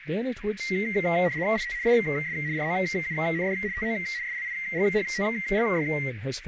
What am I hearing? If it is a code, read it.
RTTY (75 baud, 170 Hz shift), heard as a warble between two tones, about 2000 Hz centre, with radio static, a narrow filter and speech in English. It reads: IT IS ROUND TO SLIGHTLY